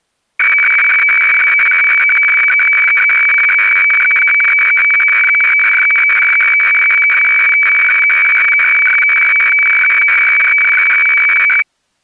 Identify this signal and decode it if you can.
Weather fax (radiofax), 120 lines a minute, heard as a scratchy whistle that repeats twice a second.